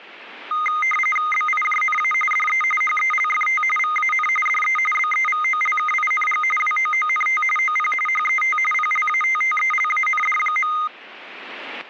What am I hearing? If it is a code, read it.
RTTY (45.45 baud, 850 Hz shift), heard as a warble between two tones, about 1650 Hz centre, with static crashes. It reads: BIJNA DE HELFT VAN DE BEVOLKING WOONT OP HET PLATTELAND.